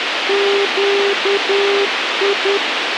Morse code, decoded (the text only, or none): QI